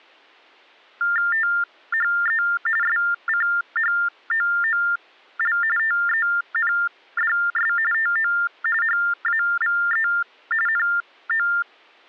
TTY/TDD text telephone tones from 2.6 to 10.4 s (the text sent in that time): SCHOOL TENDS TO HAVE